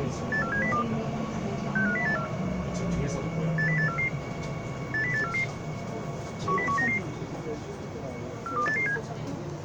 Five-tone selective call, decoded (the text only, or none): 84702 65084 80844 80844 10199 42887